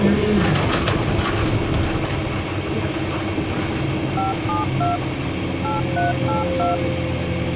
DTMF, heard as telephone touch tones, dialled by machine, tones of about 160 ms, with phone line noise and the noise inside a bus. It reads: 572 8382